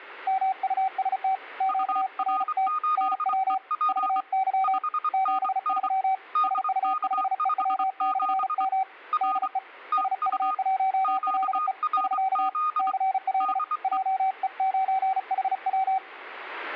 Morse code, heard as two keyed tones. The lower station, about 35 wpm, 770 Hz: MUST QRT NW VY 73 SU5EW/M DE SU1LE <SK> CL JE9HW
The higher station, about 24 wpm, 1230 Hz: UR8EP 5NN DK57 R TU QRZ DE